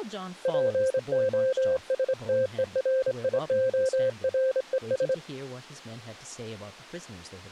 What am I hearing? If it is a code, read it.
Morse code, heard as a keyed tone, hand-sent with a straight key, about 26 wpm, 520 Hz, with speech in English. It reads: POSTERIORES